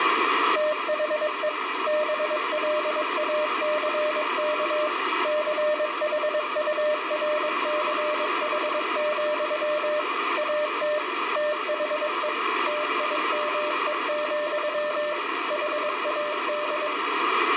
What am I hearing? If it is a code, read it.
Morse code, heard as a keyed tone, machine-sent, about 22 wpm, 600 Hz, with radio static and room echo. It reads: THE BLACK CHURCH, AT THE TIME, HAD